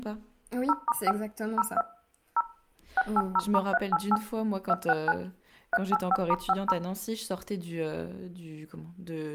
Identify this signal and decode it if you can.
DTMF, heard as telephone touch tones, dialled by machine, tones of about 40 ms, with room echo and speech in French. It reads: 0*5 02 0 680*388 269 385*50